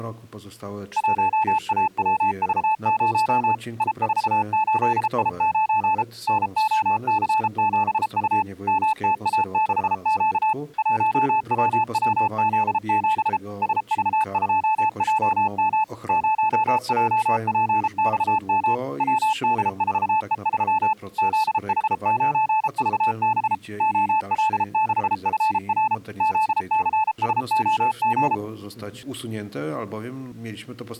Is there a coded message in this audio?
Yes: Morse code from 0.9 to 28.4 s, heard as a keyed tone, machine-sent, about 33 wpm, 870 Hz. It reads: 1AWV0 I48I9 NOC7U MTA6Q 1WWZ7 SV2JM 0JPXM WD4E3 ZH9VB OL6FR ZCSOG